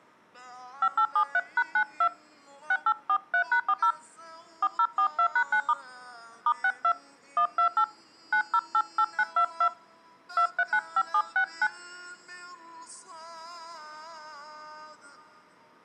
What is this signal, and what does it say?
DTMF, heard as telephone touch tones, dialled by hand, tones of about 70 ms. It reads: 5873#92 6843#40 4042#9* *62 128 9088922 2395769